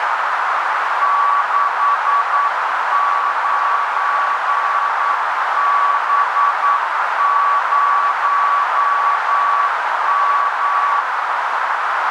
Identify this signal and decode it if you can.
Morse code, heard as a keyed tone, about 9 wpm, 1140 Hz, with heavy radio static and a narrow filter. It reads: 69B0M